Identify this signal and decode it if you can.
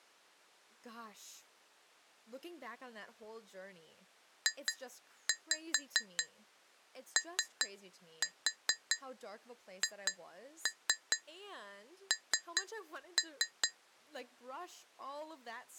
Tap code, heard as taps on glass, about 4 knocks a second, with speech in English. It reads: JOHN